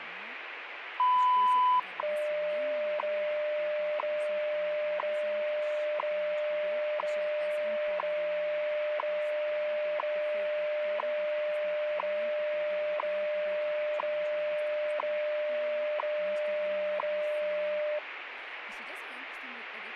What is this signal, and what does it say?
Radio time signal (WWV, Colorado), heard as ticks, one a second, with radio static and speech in Hungarian.